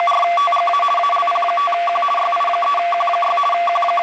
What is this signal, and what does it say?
RTTY (50 baud, 450 Hz shift), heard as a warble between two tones, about 920 Hz centre, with radio static. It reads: … ALP5Q YI3Q6 …